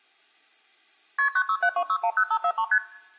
Multi-frequency trunk signalling (R1, as on North American trunks), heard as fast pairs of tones, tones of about 70 ms, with room echo. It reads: KP 9672610543 ST